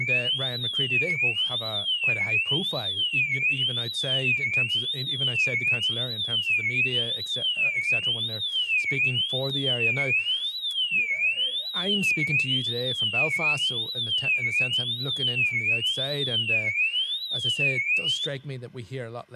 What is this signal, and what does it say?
A tone that sweeps in pitch again and again, with speech in English. There is no code.